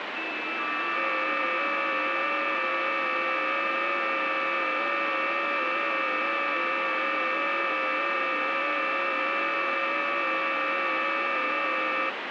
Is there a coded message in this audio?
Yes: FT8 (several signals at once) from 0.2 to 12.1 s, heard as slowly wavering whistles, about 6.25 baud, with heavy radio static.